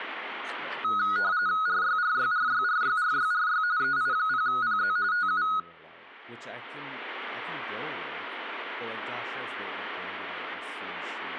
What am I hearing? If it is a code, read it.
RTTY (45.45 baud, 170 Hz shift), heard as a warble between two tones, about 1360 Hz centre, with room echo and speech in English. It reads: RYRYRYRYRYRY EI0PZ TU